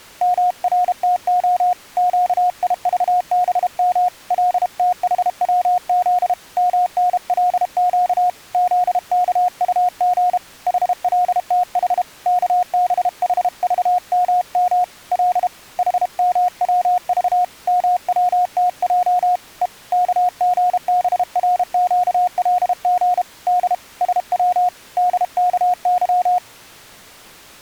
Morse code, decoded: MRTO QIVBM LTHWZ MNLQ ZKUG HLTH KBHVMM L HMWV MWTJ E KGBRQLG D SW DKY

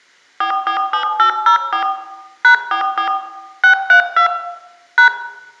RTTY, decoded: none

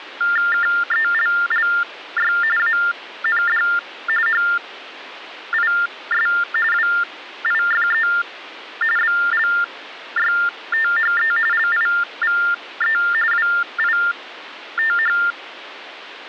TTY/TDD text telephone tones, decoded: KELLY AND HIS WIFE BLYTHE LIVE WITH

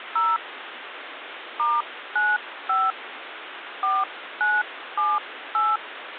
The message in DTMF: 0 *95 4978

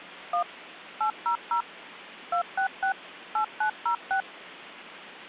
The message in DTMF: 1 800 266 8906

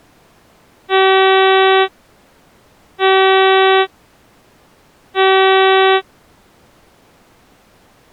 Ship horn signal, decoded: 3 short

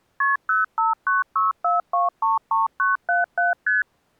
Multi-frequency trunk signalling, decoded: KP 05964233977 ST

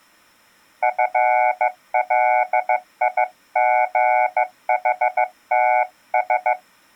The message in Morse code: FLIGHTS

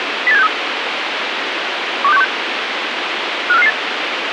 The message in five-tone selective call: 08763 12616 54558

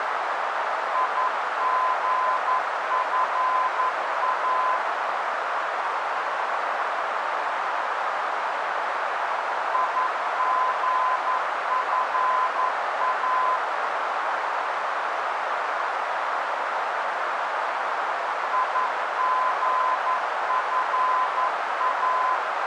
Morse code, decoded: IGFA IGFA IGFA

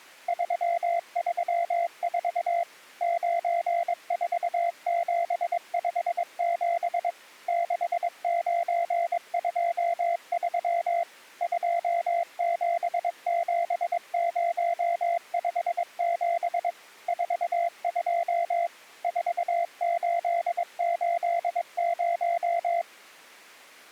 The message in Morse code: 334 94757 6923 277057 42 4880

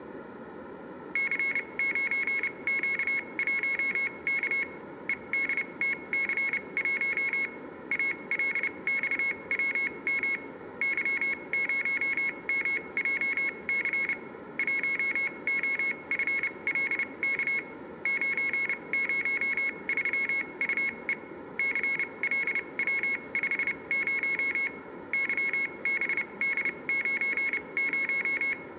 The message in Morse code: C9Q1K EDTC1 ALXWM Y0MJC 1OFLK 903UE CLW50 YBD90

